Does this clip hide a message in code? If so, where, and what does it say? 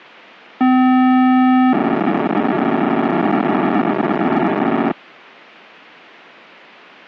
Yes: POCSAG pager data (512 baud) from 0.6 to 4.9 s, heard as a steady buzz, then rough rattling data.